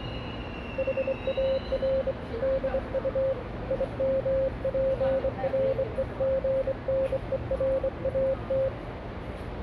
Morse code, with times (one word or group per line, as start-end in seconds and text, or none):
0.8-2.1 HAR
2.4-3.3 DU
3.7-8.7 IMPREGNERAT